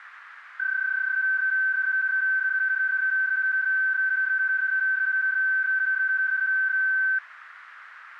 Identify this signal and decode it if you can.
PSK31 (31.25 baud), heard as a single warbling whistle, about 1550 Hz, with radio static.